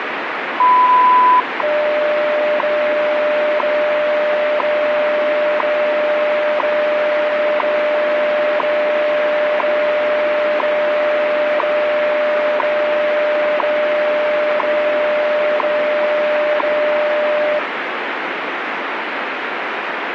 Radio time signal (WWV, Colorado), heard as ticks, one a second, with radio static.